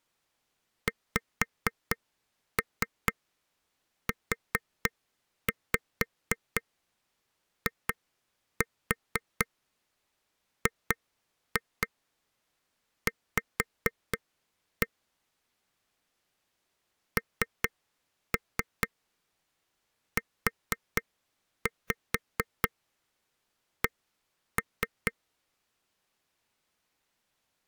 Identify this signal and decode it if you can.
Tap code, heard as taps on a table, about 4 knocks a second. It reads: XUIGV NUC